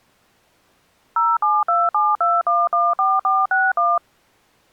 DTMF, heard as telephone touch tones, dialled by machine, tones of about 210 ms. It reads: 07272114461